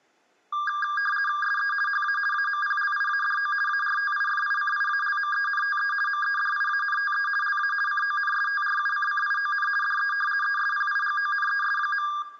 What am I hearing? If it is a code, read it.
RTTY (50 baud, 450 Hz shift), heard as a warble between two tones, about 1410 Hz centre, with room echo. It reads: SE HA AMPLIADO ARTIFICIALMENTE MEDIANTE LA CONSTRUCCION DE ESPIGONES.